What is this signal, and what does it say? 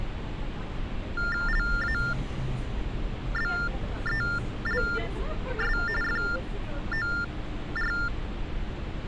TTY/TDD text telephone tones (45.45 baud Baudot), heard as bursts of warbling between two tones, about 400 Hz shift, 1600 Hz centre, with street noise. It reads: LABELS FOR